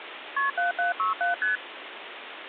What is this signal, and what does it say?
Multi-frequency trunk signalling (R1, as on North American trunks), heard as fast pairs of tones, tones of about 140 ms, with phone line noise. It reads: KP 7767 ST